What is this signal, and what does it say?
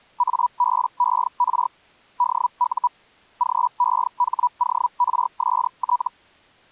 Hellschreiber (Feld-Hell, 122.5 baud), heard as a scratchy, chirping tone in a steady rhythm, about 980 Hz. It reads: ABER DU GEHORST